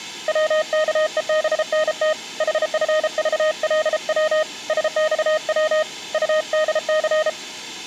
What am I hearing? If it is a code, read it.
Morse code, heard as a keyed tone, hand-sent with a paddle, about 33 wpm, 620 Hz. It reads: WKEBNT HFVLW SXW UDC